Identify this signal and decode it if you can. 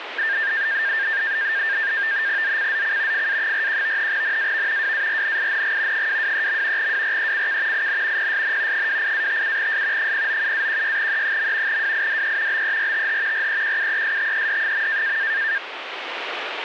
NAVTEX (SITOR-B), 100 baud, 170 Hz shift, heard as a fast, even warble, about 1700 Hz centre, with radio static. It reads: ZCZC FA41 NAV WARNING 223. WRECK IN PSN 28-57S 097-16E. WIDE BERTH REQUESTED.